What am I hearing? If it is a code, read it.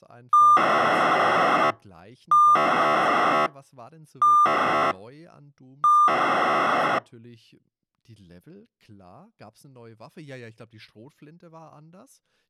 POCSAG pager data (2400 baud), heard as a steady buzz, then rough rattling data, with speech in German.